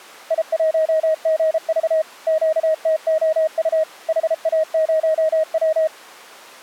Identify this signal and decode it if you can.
Morse code, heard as a keyed tone, machine-sent, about 33 wpm, 630 Hz. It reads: I1GV QTOU HA0W